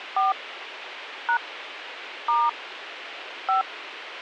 DTMF, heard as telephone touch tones, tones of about 150 ms, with radio hiss. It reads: 4 # * 5